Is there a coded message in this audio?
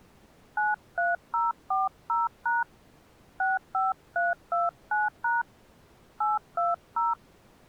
Yes: DTMF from 0.6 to 7.1 s, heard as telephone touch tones, dialled by hand, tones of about 180 ms. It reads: 93040# 65329# 820